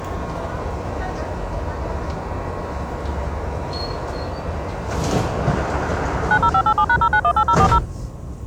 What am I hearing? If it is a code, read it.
DTMF, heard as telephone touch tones, dialled by machine, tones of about 70 ms, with the noise inside a subway train. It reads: 90587#0918040